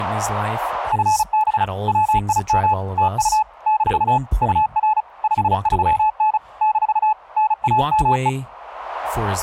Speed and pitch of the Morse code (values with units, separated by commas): 35 wpm, 860 Hz